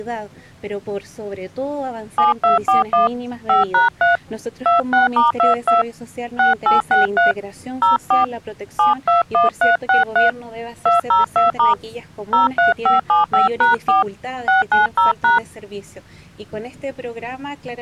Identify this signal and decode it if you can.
DTMF, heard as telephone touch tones, dialled by hand, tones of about 140 ms. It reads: 7241 5#3 26*22 6863 04 721363 202* 03575#4 690#